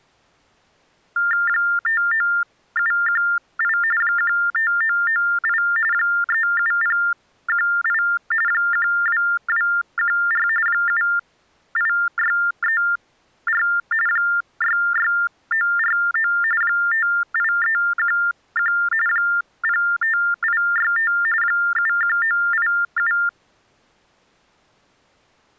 TTY/TDD text telephone tones (45.45 baud Baudot), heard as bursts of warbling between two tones, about 400 Hz shift, 1600 Hz centre. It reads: 59718 15998 37018 12214 78634 66949 58311 05865 71987